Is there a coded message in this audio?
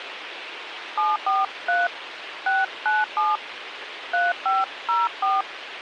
Yes: DTMF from 1.0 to 5.4 s, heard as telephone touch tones, dialled by hand, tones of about 190 ms, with radio hiss. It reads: 743 697 3504